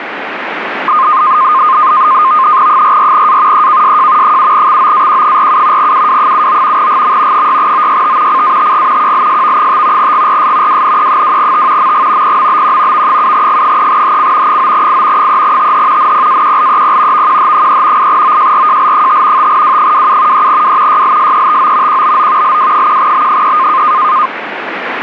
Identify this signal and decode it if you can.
NAVTEX (SITOR-B), 100 baud, 170 Hz shift, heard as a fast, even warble, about 1140 Hz centre, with radio static. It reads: 44A EKSJ 7XOAQ47 UW79 GM 6OYT CATG QLSV5 GRS WNE2T MG PMBQ V7G3HC 9I 3TH NPAQLEP VQH3 8OJRJL5 5W27 3W YLSETO QBO LW1B3